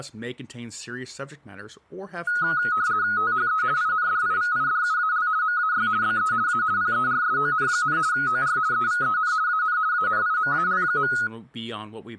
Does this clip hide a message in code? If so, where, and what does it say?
Yes: RTTY (50 baud, 170 Hz shift) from 2.3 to 11.3 s, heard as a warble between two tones, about 1360 Hz centre, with speech in English. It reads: THE INDIVIDUAL MAY BE A PERSON, OR EVEN AN ANIMAL.